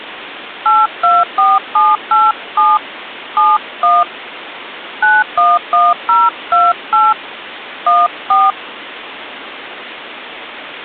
DTMF, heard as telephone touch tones, dialled by hand, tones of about 200 ms, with phone line noise. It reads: 824787 71 911028 14